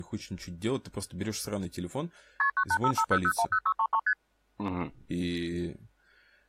Multi-frequency trunk signalling (R1, as on North American trunks), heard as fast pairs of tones, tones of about 70 ms, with speech in Russian. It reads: KP 98550010633 ST